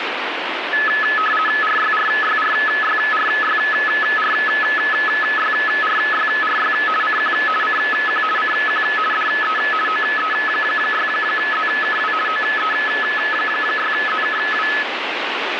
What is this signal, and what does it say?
RTTY (50 baud, 450 Hz shift), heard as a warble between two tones, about 1500 Hz centre, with radio static. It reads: RYRYRYRYRYRYRY CQ CQ CQ DE OE6ZKW OE6ZKW